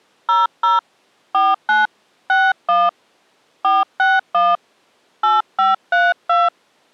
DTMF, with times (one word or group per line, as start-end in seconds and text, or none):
0.3-0.8 00
1.3-1.9 49
2.3-2.9 61
3.6-4.6 461
5.2-6.5 8532